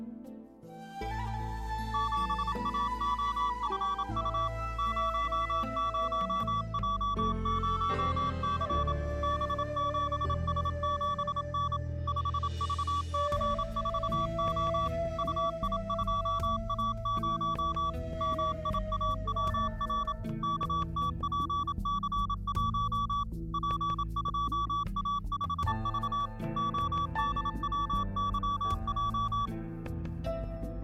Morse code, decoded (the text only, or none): 7AOFU 00J0C B7S7N 5VC4O UI2A0 MIAWR KTPC1 P2A5V ODWYJ